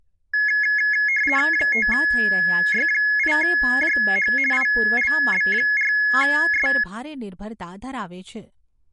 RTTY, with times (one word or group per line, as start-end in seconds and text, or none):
1.5-4.3 5Y8JH
4.5-6.7 ILB4S